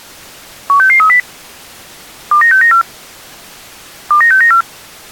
Five-tone selective call (CCIR), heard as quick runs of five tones, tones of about 100 ms. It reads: 16630 29694 29694